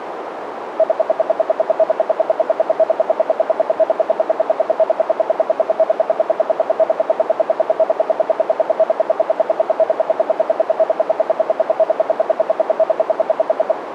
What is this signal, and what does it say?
Radio time signal (RWM, Moscow), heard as ten pulses a second, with radio static and a narrow filter.